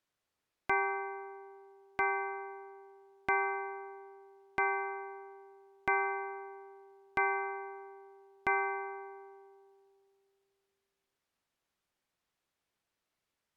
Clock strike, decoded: 7

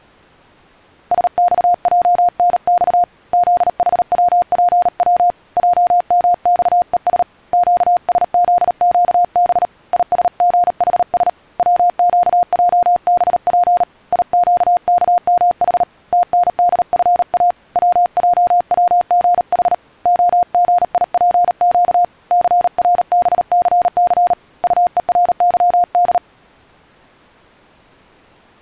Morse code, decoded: SXJNX ZHWPW JMXES QSZQB ISGHS WQJBP IQKMH TNDFA WJWGH OGIPQ CRBCC UERYD

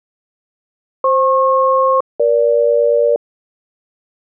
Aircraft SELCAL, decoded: FP-EG

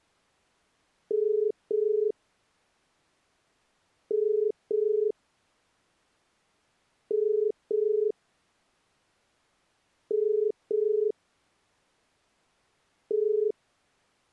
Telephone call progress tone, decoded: ringback tone

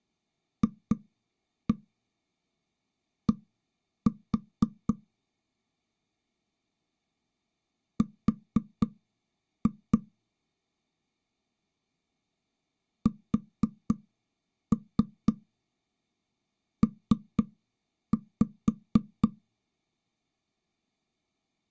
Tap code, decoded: FD R SP

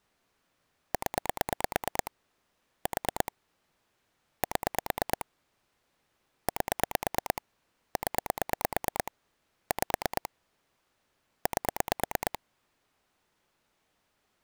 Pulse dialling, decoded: 0 4 7 8 0 5 8

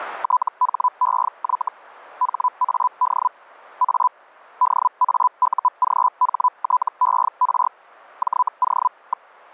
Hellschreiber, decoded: THEY HAD A DAUGHTER JO.

